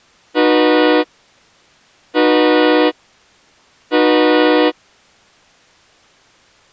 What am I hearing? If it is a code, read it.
Train horn signal, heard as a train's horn. 3 short. On North American railways: when stopped, the train will back up.